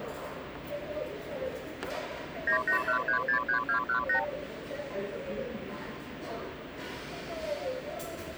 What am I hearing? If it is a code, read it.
Multi-frequency trunk signalling (R2, with the far end's replies), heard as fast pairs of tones, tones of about 100 ms, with the noise of a restaurant. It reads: 981363218